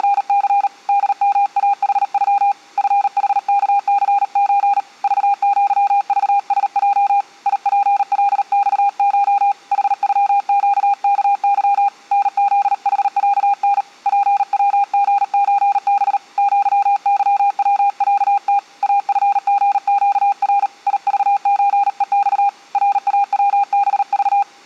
Morse code (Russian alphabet), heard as a keyed tone, hand-sent with a paddle, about 38 wpm, 800 Hz. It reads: … ДМАХЮ ФХКЦЧ ЖЪЖСЙ ИПЛЬШ ХЮЩКЫ НЗХЯН ПВГЧБ ЪЫВЯТ АФГЩР ИЖЧЕЬ РАВБЖ